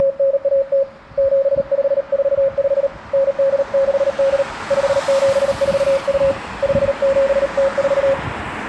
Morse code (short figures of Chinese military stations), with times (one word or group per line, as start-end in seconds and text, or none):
0.0-0.8 …
1.2-2.9 7545
3.1-4.4 9868
4.7-6.3 5742
6.6-8.1 5704